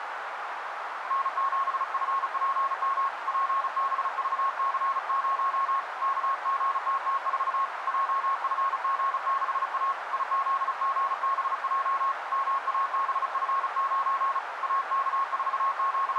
Morse code, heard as a keyed tone, hand-sent with a paddle, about 35 wpm, 1090 Hz, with radio static and a narrow filter. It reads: N7FPM PBVC0 KGTT4 JFG6A IZGBJ MABF9 …